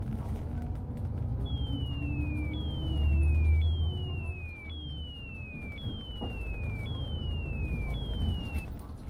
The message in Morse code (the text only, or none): none